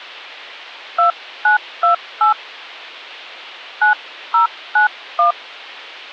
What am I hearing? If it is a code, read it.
DTMF, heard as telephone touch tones, dialled by hand, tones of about 120 ms. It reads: 2928 9091